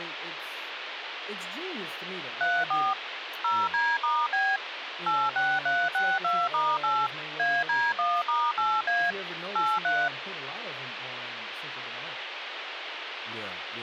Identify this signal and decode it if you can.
DTMF, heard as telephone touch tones, dialled by machine, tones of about 230 ms, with phone line noise and speech in English. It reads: 34 0D*B 86362*8 AD1*8A 83